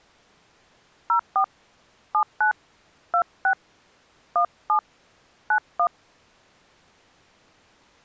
DTMF, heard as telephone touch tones, dialled by hand, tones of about 90 ms. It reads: 04 79 26 17 91